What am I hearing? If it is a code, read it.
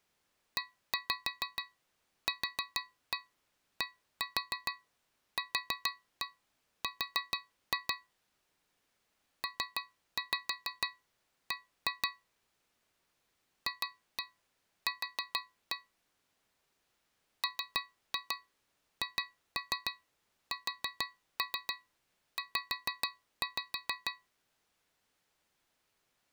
Tap code, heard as taps on a metal pipe, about 6 knocks a second. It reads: EQDQR PB FQ MHSZ